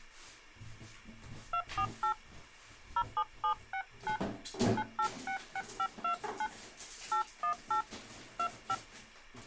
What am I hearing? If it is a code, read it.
DTMF, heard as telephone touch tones, dialled by hand, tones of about 80 ms, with the noise of a restroom. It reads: 248 07769 9866529 818 25